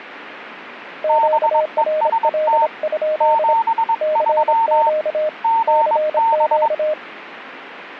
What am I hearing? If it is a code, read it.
Morse code, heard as two keyed tones. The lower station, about 26 wpm, 620 Hz: QRL? CQ CQ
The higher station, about 22 wpm, 910 Hz: BEST 73 GB